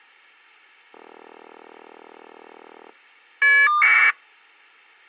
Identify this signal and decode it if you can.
Caller ID data burst, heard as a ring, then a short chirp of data, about 1200 baud.